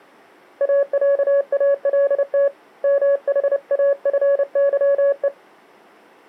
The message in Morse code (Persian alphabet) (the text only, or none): اصالت محافظه